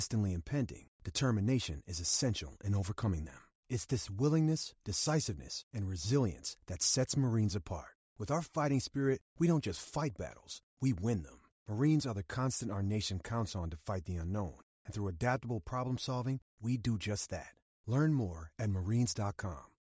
Speech in English. There is no code.